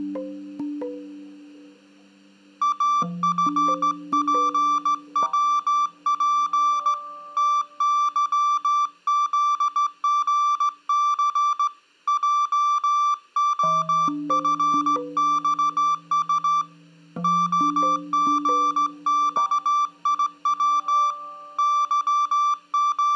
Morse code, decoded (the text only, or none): AFPWP TYZGC JOFXU OGXIW …